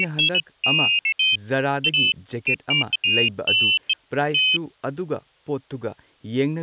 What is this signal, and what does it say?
Pairs of high tones at irregular times, with speech in Manipuri. There is no code.